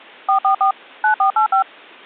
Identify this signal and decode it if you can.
DTMF, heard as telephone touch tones, dialled by machine, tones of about 100 ms. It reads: 444 9485